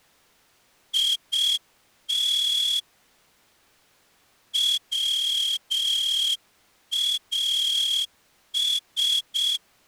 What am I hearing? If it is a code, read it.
Morse code, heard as a whistle, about 6 wpm. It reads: IT WAS